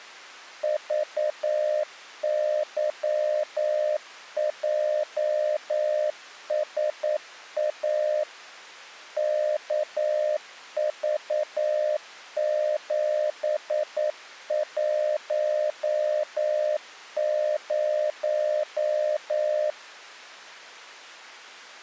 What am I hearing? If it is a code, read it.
Morse code, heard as a keyed tone, machine-sent, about 9 wpm, 610 Hz. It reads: VYJSA KV710